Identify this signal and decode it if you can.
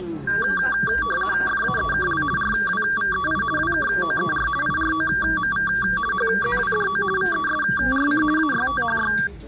RTTY (50 baud, 450 Hz shift), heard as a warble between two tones, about 1370 Hz centre, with the noise of a restaurant. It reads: FAEKL RWVEI WKOER IROMV HZWDO VESRC AYTHY